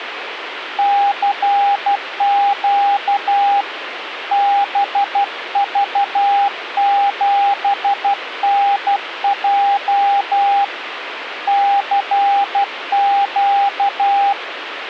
Morse code, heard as a keyed tone, hand-sent with a paddle, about 12 wpm, 800 Hz, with radio static. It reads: CQ BV7NJ CQ